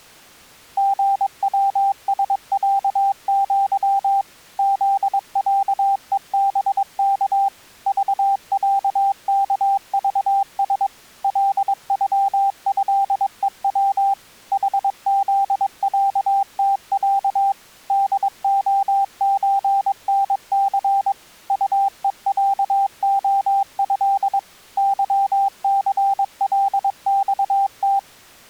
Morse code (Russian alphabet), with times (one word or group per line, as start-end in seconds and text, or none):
0.8-4.2 ГВСЯЪ
4.6-7.5 ЗЯЕБК
7.9-10.9 ЖЯКЖС
11.2-14.1 ЛЮЭЕВ
14.5-17.5 ХЗЯТЯ
17.9-21.1 ДОЧНЦ
21.5-24.4 УЕЯОЭ
24.8-28.0 ЫЦЛЬТ